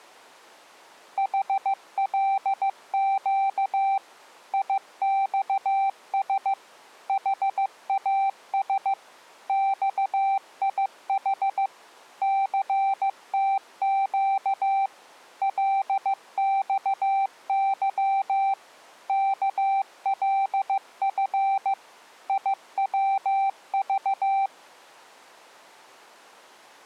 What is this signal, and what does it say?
Morse code, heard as a keyed tone, machine-sent, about 15 wpm, 780 Hz. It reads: HLQ IXS HAS XIH CTQ LXY KLF IWV